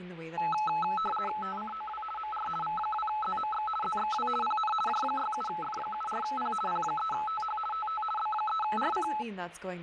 RTTY (50 baud, 450 Hz shift), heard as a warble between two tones, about 1080 Hz centre, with radio static and speech in English. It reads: TCOW MR V2ZMX ZXW PN J67F74P P3TH TT B3RC